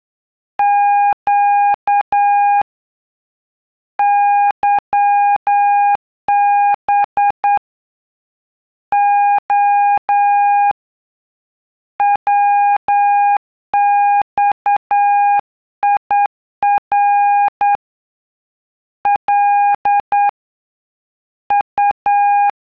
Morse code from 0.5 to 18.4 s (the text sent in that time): Q YB O WXIR